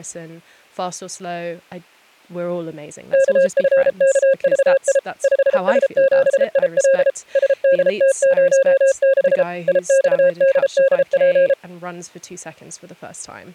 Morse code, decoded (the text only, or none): KFKVI 5S7IL SDT06 IXDDP